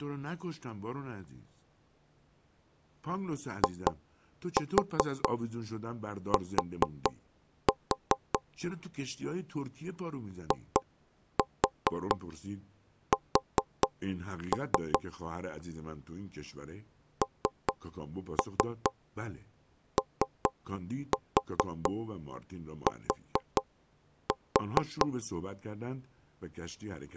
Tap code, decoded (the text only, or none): IT IS NOT